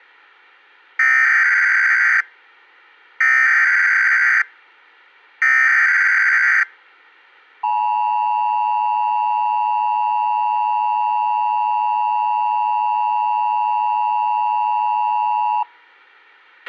Emergency Alert System (SAME) tones (header bursts, then the 853 and 960 Hz attention tone), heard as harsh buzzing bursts, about 520.83 baud, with a squelch burst at the end.